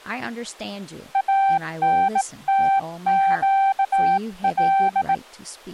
Morse code (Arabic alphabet), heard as a keyed tone, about 18 wpm, 780 Hz, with speech in English. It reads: انتقل